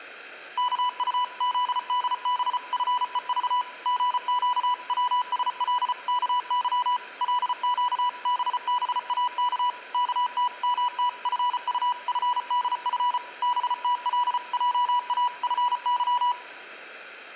Morse code (Korean alphabet), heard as a keyed tone, machine-sent, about 34 wpm, 980 Hz, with room echo. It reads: 이튿날 새벽에 개똥 어머니는 덕호네